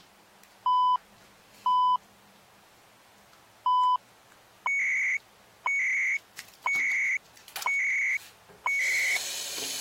Radio time signal (CHU, Canada), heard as beeps and data bursts, one a second, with the noise of a restroom.